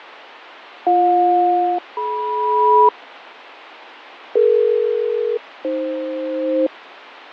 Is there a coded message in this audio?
Yes: aircraft SELCAL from 0.9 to 6.7 s, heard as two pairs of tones, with radio static and fading. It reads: BJ-DM DE-AF